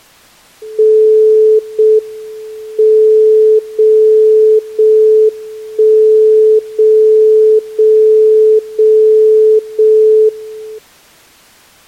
Radio time signal (JJY), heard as a tone whose level steps once a second, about 430 Hz. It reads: 0 M 0 0 1 0 0 0 0 1